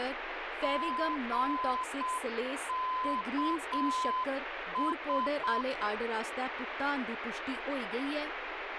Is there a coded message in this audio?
Yes: Morse code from 0.6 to 5.7 s, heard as a keyed tone, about 7 wpm, 1020 Hz, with radio static and speech in Dogri. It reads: GKS